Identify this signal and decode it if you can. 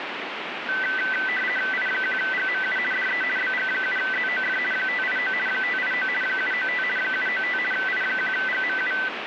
RTTY (50 baud, 450 Hz shift), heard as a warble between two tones, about 1750 Hz centre, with radio static. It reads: I1GMU DE BG7ZOF 589 589 795 795 I1GMU